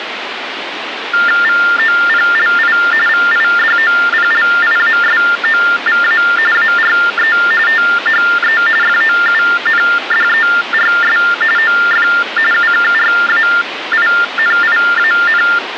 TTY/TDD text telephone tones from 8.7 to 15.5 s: FOUNDERS OF UKRAINIAN

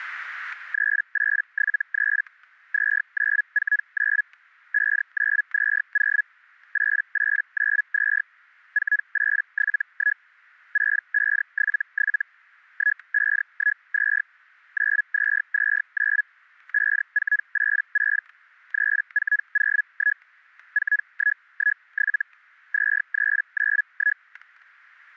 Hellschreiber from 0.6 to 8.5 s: 3873 2949 5920 8892

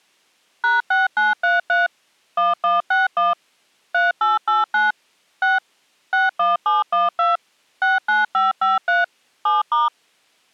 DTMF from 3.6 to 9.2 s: 3889 6 61712 69553

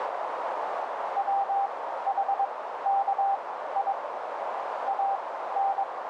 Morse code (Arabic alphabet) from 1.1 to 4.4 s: وحكي

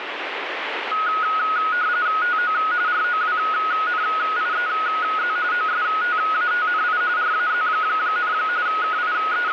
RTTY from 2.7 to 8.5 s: ROWNIEZ OSTATNI RAZ,

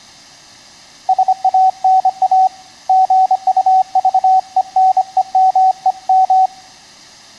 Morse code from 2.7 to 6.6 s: GUVENEMEM

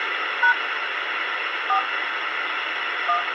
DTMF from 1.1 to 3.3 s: 4 1

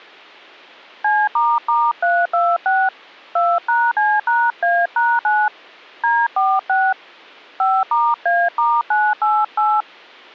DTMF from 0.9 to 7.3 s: C**326 2#C#A#9 D46

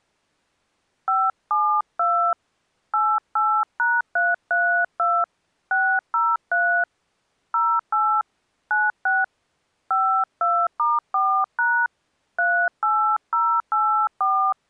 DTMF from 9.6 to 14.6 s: 52*4# 38084

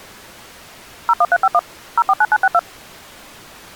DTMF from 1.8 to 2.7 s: 049962

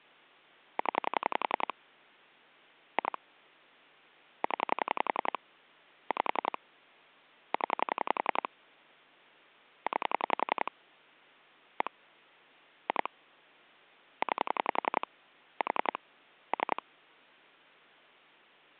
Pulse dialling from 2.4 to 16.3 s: 2 0 5 0 9 1 2 9 4

